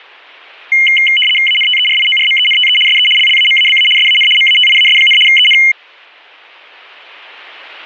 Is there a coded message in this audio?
Yes: RTTY (75 baud, 850 Hz shift) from 0.7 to 5.7 s, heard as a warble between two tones, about 2550 Hz centre. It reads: ANTERIORMENTE SE LLAMABA SAN MATIAS, EN